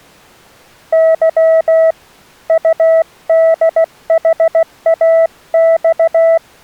Morse code, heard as a keyed tone, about 16 wpm, 650 Hz. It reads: Y UDHAX